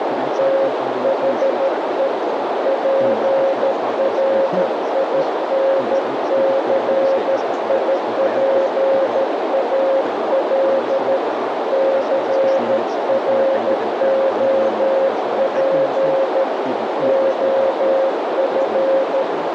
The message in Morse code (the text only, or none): THE PRINCIPAL CROP OF